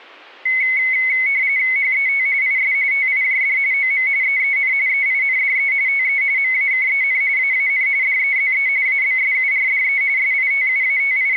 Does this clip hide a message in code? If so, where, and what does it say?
Yes: RTTY (45.45 baud, 170 Hz shift) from 0.5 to 11.4 s, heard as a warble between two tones, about 2150 Hz centre. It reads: HET IS TIJD OM EEN EINDE TE MAKEN AAN DEZE ABSURDE …